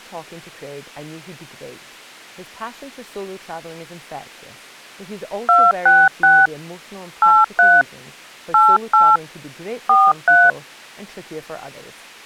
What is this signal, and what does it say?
DTMF, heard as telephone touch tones, dialled by hand, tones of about 220 ms, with speech in English. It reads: 266 83 88 43